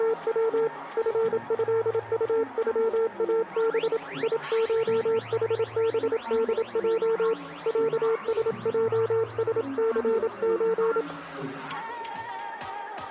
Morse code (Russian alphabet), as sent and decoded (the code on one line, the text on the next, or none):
… / ..-. ..-.. ..- ..-- .- -... / .. ---- .... -... -.. .--- / .-.- ... .--- ... -.-. ---.
… ФЭУЮАБ ИШХБДЙ ЯСЙСЦЧ